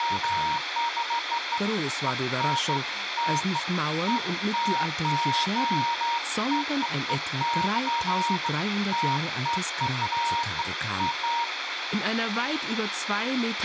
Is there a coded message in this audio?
No, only beeps of irregular length, with radio hiss, a squelch burst at the end and room echo.